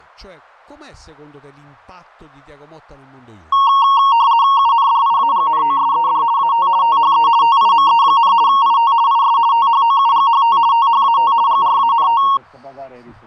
RTTY (50 baud, 170 Hz shift), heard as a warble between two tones, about 1010 Hz centre. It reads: UNDIAGNOSED AT THE TIME, IT IS THOUGHT THAT GRANT